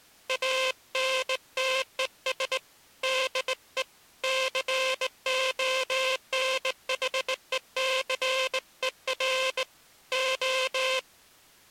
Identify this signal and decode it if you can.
Morse code, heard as a buzzer, hand-sent with a straight key, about 19 wpm. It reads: ANTES DE CONHECER O